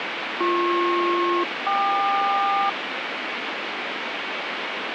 Aircraft SELCAL, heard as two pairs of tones, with radio static. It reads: BP-KQ